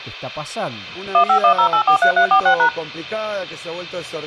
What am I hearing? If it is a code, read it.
DTMF, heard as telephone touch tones, dialled by machine, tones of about 90 ms. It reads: 1510843346#